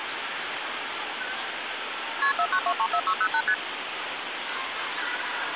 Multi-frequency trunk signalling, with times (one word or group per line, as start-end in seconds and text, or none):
2.2-2.3 KP
2.4-3.4 49234608
3.5-3.5 ST